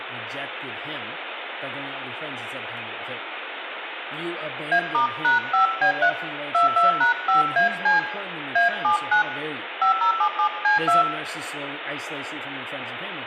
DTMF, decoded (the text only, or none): A*#5B3 22#5AC A79 5077C2